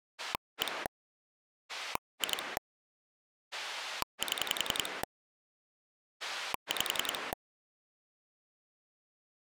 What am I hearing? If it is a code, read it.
Pulse dialling, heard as a rotary dial, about 10 pulses a second. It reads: 1 2 7 5